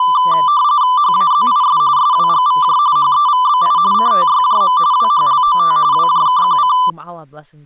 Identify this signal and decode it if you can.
RTTY (45.45 baud, 170 Hz shift), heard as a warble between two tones, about 1090 Hz centre, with speech in English. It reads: HAZIS SWGVJ HEVBI CTYJM WHLOT WJKQC